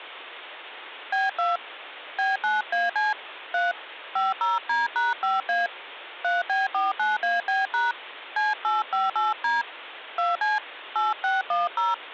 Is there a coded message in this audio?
Yes: DTMF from 1.1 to 11.9 s, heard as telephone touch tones, dialled by hand, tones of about 170 ms, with phone line noise. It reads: B2 B9AC 3 50D#5A 3B49AB# C858D 2C 8610